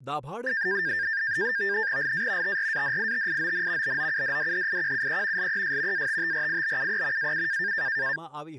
NAVTEX (SITOR-B), 100 baud, 170 Hz shift, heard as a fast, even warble, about 1700 Hz centre, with speech in Gujarati. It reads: LA TRADITION BOUDDHIQUE LES ATTRIBUE AU